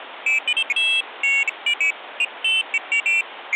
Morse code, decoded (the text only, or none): none